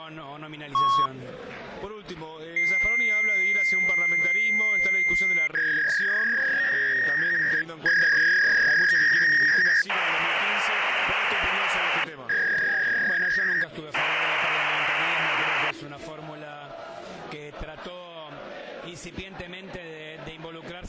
Fax machine handshake, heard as a long tone, a warble and hiss.